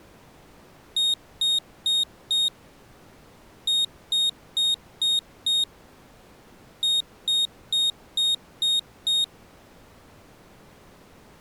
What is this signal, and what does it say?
Beep code, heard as a piezo beeper, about 3700 Hz. 4-5-6.